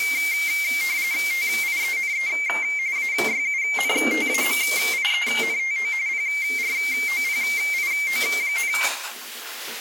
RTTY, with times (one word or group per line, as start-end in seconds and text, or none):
1.3-2.3 TIENE
3.0-5.9 AYUNTAMIENTO
6.1-8.7 PROPIO,